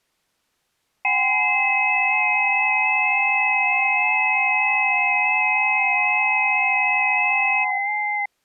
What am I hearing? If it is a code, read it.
FT8 (several signals at once), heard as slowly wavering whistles, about 6.25 baud.